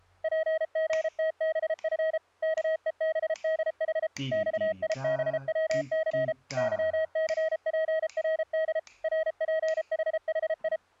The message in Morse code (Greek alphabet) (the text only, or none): ΠΓΤΒΦ ΚΕΒΔΗ ΞΙΒΩΘ ΥΘΠΡΔ ΡΠΗΗΙ